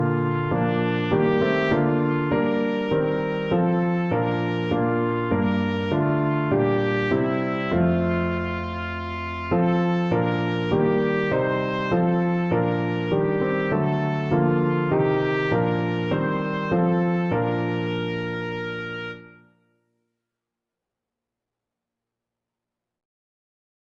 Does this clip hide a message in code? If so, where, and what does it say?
No.